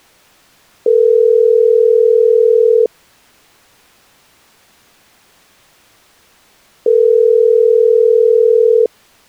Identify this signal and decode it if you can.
Telephone call progress tone (North American plan), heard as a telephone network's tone, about 440, 480 Hz, 2 s on and 4 s off. Ringback tone.